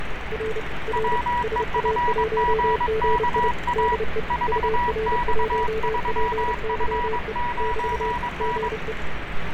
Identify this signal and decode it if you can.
Morse code, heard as two keyed tones, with radio static and street noise. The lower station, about 30 wpm, 440 Hz: R R SA1GI DE UR1PYE <BT> GE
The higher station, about 22 wpm, 970 Hz: WEFGKA 4X3F9N